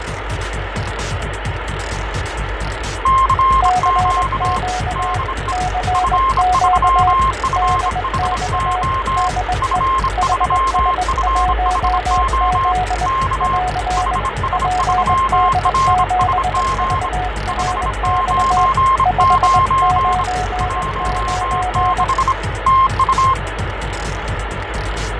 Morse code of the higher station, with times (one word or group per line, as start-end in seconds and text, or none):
3.1-4.6 CQ
5.0-5.5 DE
5.9-9.3 F3FHO
9.6-12.7 F3FHO
13.1-13.6 K
14.0-17.1 HS3RSG
17.5-20.2 599
20.6-22.3 16
22.7-23.3 TU